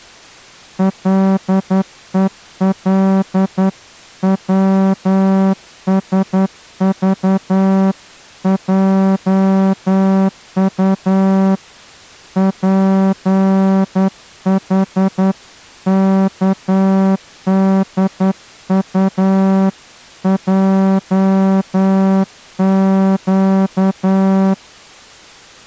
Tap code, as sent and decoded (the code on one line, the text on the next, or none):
none